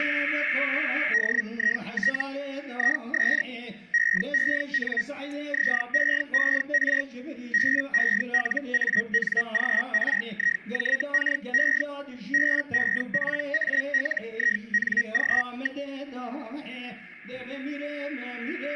Hellschreiber (Feld-Hell, 122.5 baud), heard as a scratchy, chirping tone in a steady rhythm, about 1900 Hz. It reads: DIT IS EEN ZEER BELANGRIJKE BEPALING.